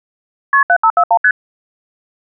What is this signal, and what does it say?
Multi-frequency trunk signalling (R1, as on North American trunks), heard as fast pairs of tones, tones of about 70 ms. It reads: KP 7541 ST